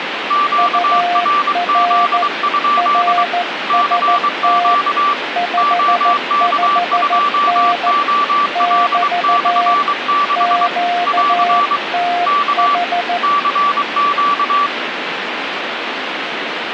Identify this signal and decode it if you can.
Morse code, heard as two keyed tones, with radio static. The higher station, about 23 wpm, 1160 Hz: QRZ? CQ OK2OL/6 <AR> K CQ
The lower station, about 14 wpm, 700 Hz: UR RST 55N <BT> QTH